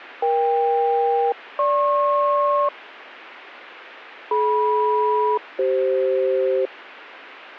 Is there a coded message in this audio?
Yes: aircraft SELCAL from 0.2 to 6.7 s, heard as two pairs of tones. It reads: EK-GP DM-CF